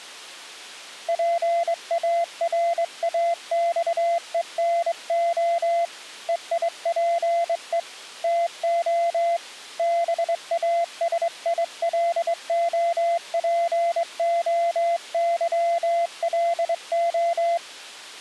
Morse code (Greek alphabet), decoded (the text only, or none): ΠΑΡΑΞΕΝΟ ΕΙΠΕ ΤΟ ΒΑΣΙΛΟΠΟΥΛΟ